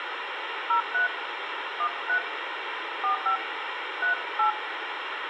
DTMF, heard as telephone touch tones, dialled by hand, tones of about 90 ms, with radio hiss and room echo. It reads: 03 13 45 38